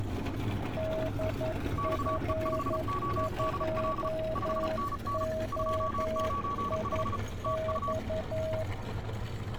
Morse code, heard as two keyed tones, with street noise. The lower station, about 11 wpm, 640 Hz: DF2OIX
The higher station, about 35 wpm, 1130 Hz: XE5ODL 5NN 295 TU